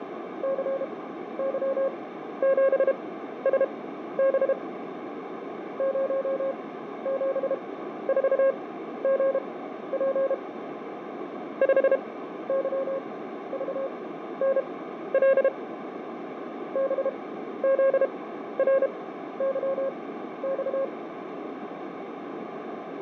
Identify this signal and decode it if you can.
Morse code, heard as a keyed tone, machine-sent, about 32 wpm, spaced as for 13 wpm, 540 Hz, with radio static, fading and a narrow filter. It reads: CY7SB 074GP 5YVNL BZRYX